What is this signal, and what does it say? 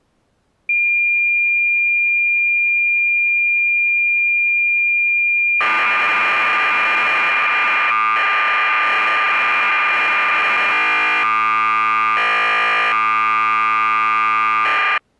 Cassette data (Kansas City type), 1200 baud, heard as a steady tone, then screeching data.